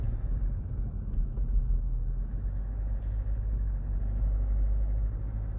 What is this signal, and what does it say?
The noise inside a car. There is no code.